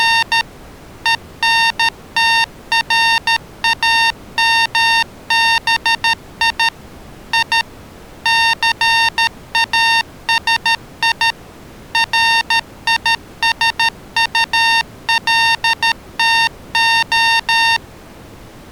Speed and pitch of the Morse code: 13 wpm, 920 Hz

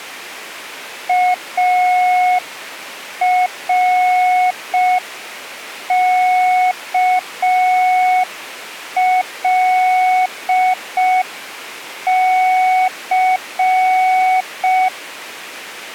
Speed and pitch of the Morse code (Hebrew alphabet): 5 wpm, 740 Hz

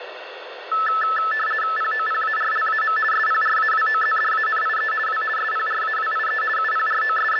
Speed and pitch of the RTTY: 50 baud, 450 Hz shift, 1500 Hz centre

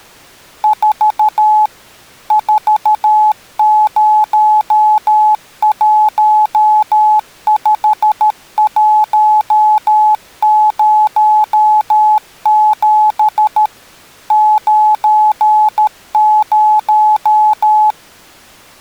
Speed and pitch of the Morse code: 13 wpm, 850 Hz

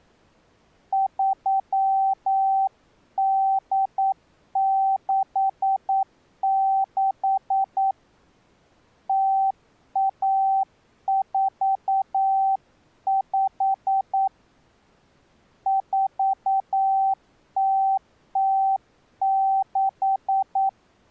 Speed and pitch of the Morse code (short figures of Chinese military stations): 9 wpm, 780 Hz

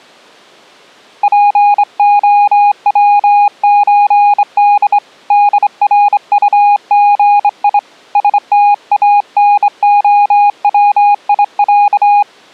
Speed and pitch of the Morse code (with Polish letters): 25 wpm, 820 Hz

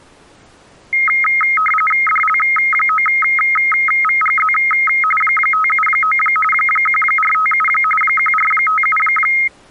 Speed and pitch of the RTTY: 45.45 baud, 850 Hz shift, 1700 Hz centre

